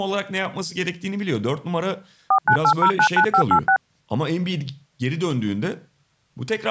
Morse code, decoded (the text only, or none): none